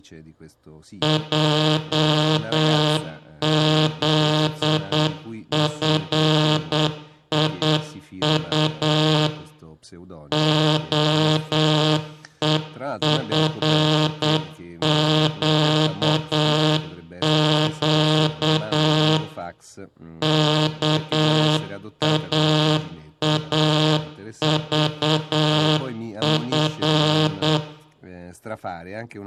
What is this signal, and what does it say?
Morse code, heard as a buzzer, machine-sent, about 8 wpm, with room echo and speech in Italian. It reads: JZFIU OEFQQ KAAVF